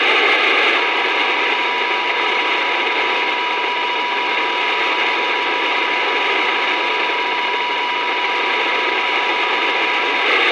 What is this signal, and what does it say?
PSK31 (31.25 baud), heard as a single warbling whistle, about 980 Hz, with radio static.